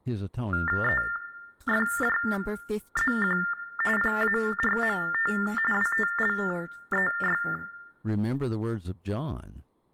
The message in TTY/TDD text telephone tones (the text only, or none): EFJZQ PARMT WTLEY